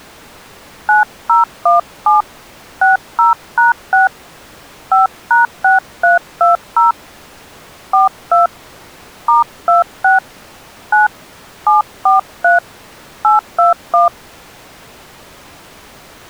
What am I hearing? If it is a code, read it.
DTMF, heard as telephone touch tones, dialled by hand, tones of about 140 ms. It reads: 9017 60#6 5#6320 42 *26 9 743 821